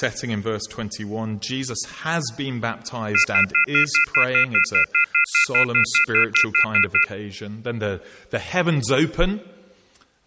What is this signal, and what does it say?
Telephone call progress tone (North American plan), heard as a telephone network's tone, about 1400, 2050, 2450, 2600 Hz, 0.1 s on and 0.1 s off. Off-hook warning tone.